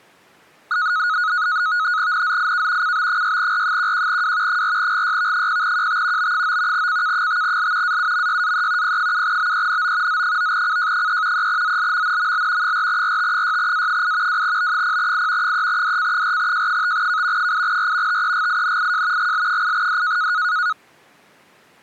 NAVTEX (SITOR-B), 100 baud, 170 Hz shift, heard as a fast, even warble, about 1360 Hz centre. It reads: NZIK CB6R11W 4GYV0QT B9 CK5L AUMYAE P7BENO Z9CJ3 3ZLMNML 4RT6A8 2B0I 3DC4J5K 8R TEGINIJ GL8D